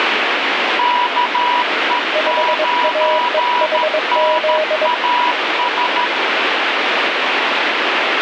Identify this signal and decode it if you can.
Morse code, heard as two keyed tones, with radio static. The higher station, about 13 wpm, 980 Hz: KE9NAS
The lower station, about 22 wpm, 620 Hz: 5AEHZ